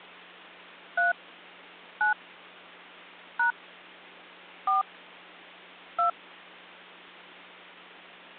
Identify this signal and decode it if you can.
DTMF, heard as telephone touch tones, dialled by hand, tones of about 130 ms, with hum. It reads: 3 9 # 4 2